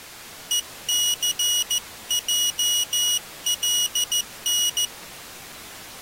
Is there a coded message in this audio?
Yes: Morse code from 0.5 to 4.9 s, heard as a high beeper, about 14 wpm, 2900 Hz. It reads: ECJLN